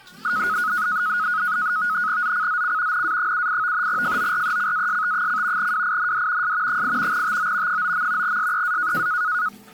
NAVTEX (SITOR-B), 100 baud, 170 Hz shift, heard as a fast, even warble, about 1360 Hz centre, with the noise of a restroom. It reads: ZCZC NA78 FORECAST: WIND S 8 TO 9. SEA